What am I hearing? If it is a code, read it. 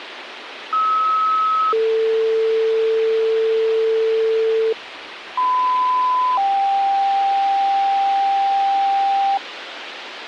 Two-tone page, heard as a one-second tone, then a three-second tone, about 1290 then 450 Hz, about 1010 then 790 Hz, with radio hiss.